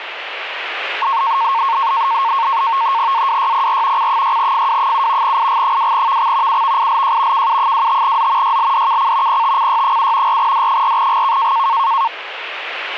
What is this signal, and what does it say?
NAVTEX (SITOR-B), 100 baud, 170 Hz shift, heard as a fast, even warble, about 1000 Hz centre, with radio static. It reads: AWYPR C6FW7 IG2VX UVILJ KU25Z YLDKC PTCY7 4D4GK